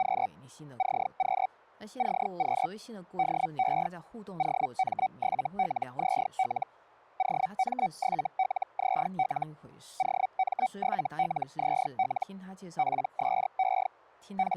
Hellschreiber (Feld-Hell, 122.5 baud), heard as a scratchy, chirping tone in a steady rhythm, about 760 Hz, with speech in Chinese. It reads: … CQ CQ DE OM7LZL OM7LZL OM7LZL PSE …